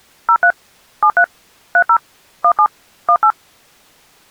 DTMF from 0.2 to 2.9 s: 03 73 30 17

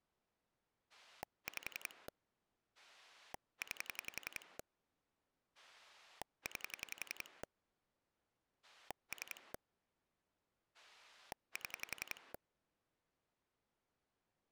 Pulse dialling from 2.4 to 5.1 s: 9

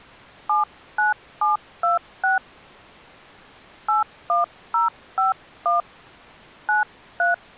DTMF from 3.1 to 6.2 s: 81051

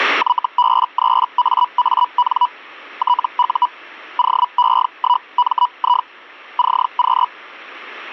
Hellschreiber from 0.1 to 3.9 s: YB3AAN TU

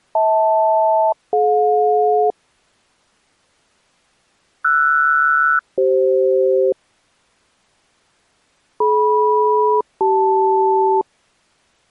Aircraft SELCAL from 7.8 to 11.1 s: DM-CL

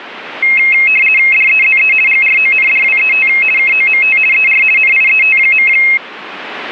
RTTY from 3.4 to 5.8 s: KOMT ER NIET.

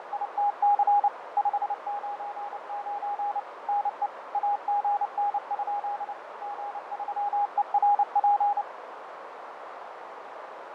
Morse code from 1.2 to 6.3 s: 599 NE AGN?

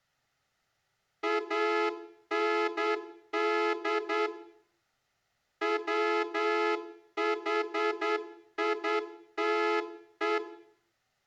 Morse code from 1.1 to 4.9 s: AND

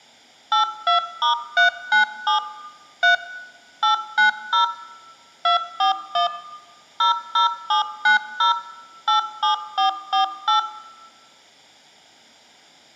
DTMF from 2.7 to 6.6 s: 3 890 241

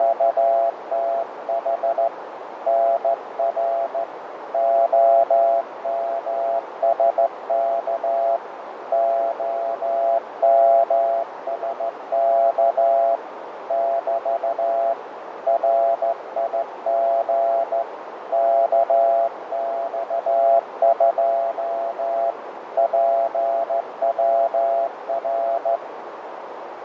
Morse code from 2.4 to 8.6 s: NR OMSK

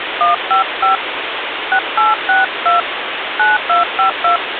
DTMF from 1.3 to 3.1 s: 6862

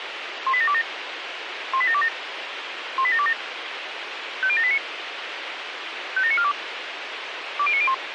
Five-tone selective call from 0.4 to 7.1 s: 18727 18727 18727 50789 57942

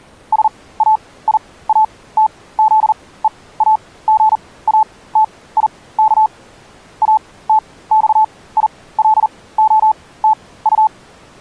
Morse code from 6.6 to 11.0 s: ATXILOTU

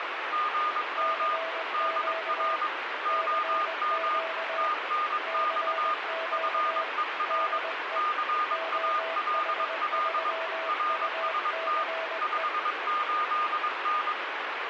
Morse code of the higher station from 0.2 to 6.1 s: GM DR OM TNX

